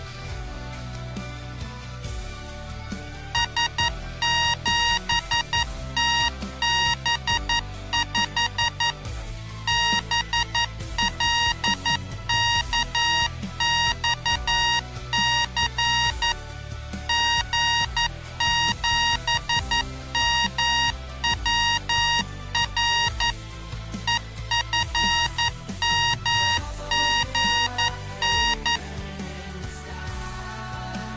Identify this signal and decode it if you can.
Morse code, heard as electronic beeps, machine-sent, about 11 wpm, 940 Hz. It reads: S7TB5 BLKXC G7MWR EFMGN